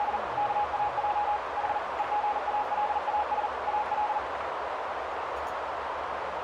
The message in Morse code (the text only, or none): … KAJ H EGALAS AL